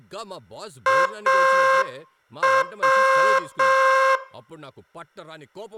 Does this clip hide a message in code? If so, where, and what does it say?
Yes: Morse code (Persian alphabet) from 0.8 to 4.2 s, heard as a buzzer, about 6 wpm, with room echo and speech in Telugu. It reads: او